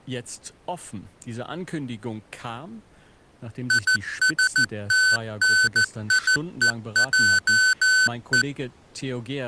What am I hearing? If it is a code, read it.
Morse code, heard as electronic beeps, machine-sent, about 14 wpm, 1500 Hz, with speech in German. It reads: ISTNIEJE